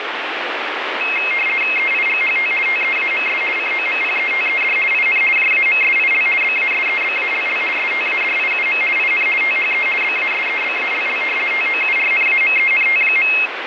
RTTY (50 baud, 450 Hz shift), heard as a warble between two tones, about 2350 Hz centre, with radio static. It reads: EIGHT TEAMS COMPETED IN JAMSIL BASEBALL STADIUM IN THE BASEBALL TOURNAMENT.